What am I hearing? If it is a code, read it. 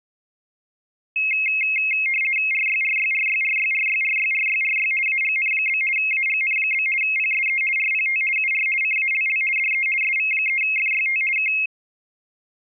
RTTY (50 baud, 450 Hz shift), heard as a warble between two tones, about 2350 Hz centre. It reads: RYRYRYRYRYRYRYRY AGN? AGN? PSE RPT UR CALL DE SV3FYT K